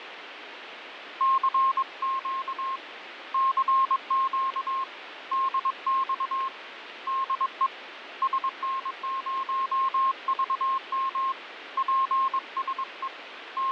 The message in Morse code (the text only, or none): CQ CQ DX DE SN0VM PSE …